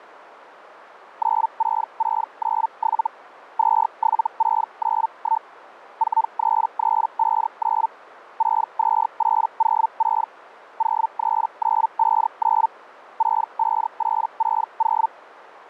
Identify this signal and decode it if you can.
Hellschreiber (Feld-Hell, 122.5 baud), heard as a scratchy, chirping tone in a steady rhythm, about 900 Hz. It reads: 96697 27691 43359 62806 03959 65860